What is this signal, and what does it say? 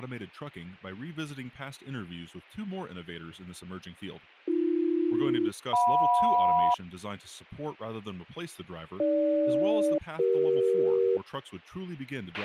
Aircraft SELCAL, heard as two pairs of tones, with a squelch burst at the end and speech in English. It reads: AB-JM AG-CE